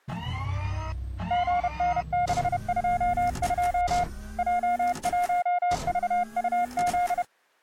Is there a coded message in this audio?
Yes: Morse code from 1.2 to 7.3 s, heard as a keyed tone, hand-sent with a paddle, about 31 wpm, 710 Hz. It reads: GN622 J1VUZ